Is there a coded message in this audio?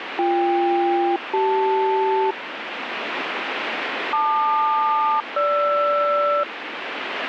Yes: aircraft SELCAL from 0.2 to 6.4 s, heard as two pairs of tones, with radio static. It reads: BK-CL LQ-GR